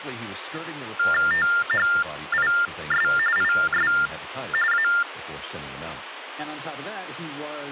TTY/TDD text telephone tones (45.45 baud Baudot), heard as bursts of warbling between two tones, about 400 Hz shift, 1600 Hz centre, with phone line noise and speech in English. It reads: THIS IS A